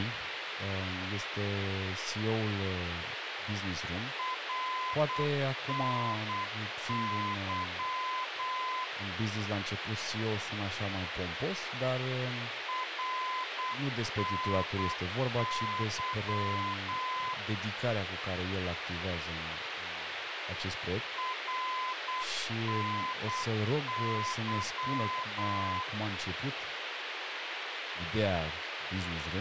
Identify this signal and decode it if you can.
Morse code, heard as a keyed tone, machine-sent, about 8 wpm, 1020 Hz, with radio hiss and speech in Romanian. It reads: RNY RNY RNY